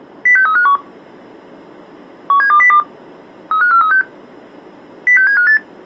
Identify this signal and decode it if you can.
Five-tone selective call (CCIR), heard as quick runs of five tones, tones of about 100 ms. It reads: 06351 17202 35436 06758